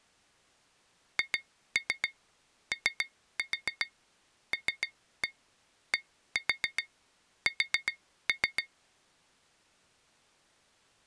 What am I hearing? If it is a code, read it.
Tap code, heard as taps on glass, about 7 knocks a second. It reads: HOLDS